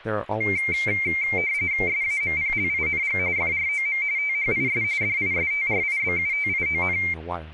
RTTY (45.45 baud, 170 Hz shift), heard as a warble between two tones, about 2200 Hz centre, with static crashes and speech in English. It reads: SAMPLING FROM THIS DISTRIBUTION